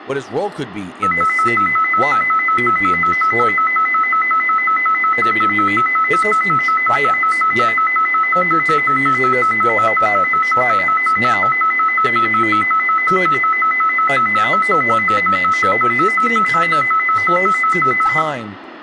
A tone that alternates evenly between two pitches, with phone line noise, room echo and speech in English. There is no code.